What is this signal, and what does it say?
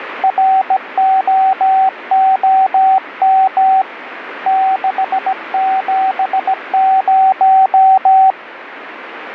Morse code, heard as a keyed tone, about 17 wpm, 760 Hz, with radio static. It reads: ROOM 670